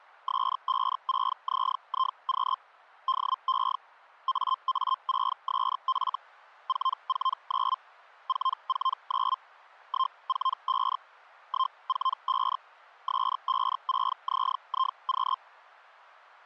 Hellschreiber (Feld-Hell, 122.5 baud), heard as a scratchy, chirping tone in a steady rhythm, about 1050 Hz. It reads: S56ZIQ DE AA6SF 449 449 145 145 S56ZIQ